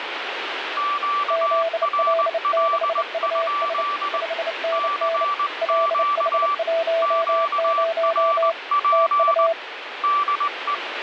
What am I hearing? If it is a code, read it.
Morse code, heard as two keyed tones, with radio static. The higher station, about 20 wpm, 1160 Hz: QRL? CQ QRP DE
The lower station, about 29 wpm, 660 Hz: ZL6US 5NN LH10 TU